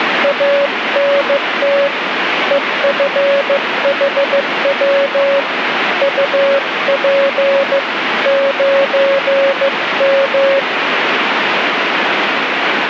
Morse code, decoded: ANT EFHW UP 9M

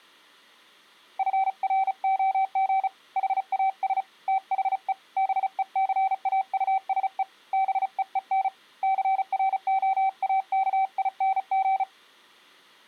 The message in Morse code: FROG HAS THE BECAUSE BEEN CROAKING

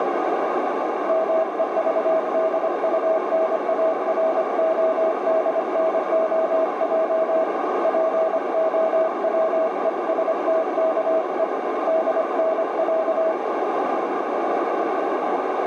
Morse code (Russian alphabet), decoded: МЕЖДУНАРОДНОЙ ПОВЕСТКЕ ДНЯ

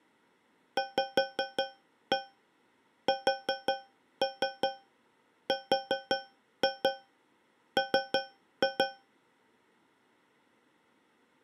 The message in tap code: VSRM

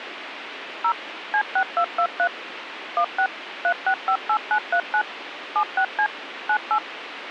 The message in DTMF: 0 C6223 16 3658939 76C 98

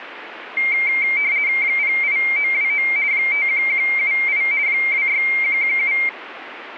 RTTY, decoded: 08929 51178 26117

